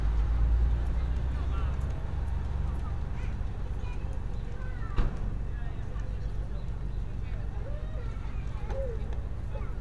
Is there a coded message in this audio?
No, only street noise.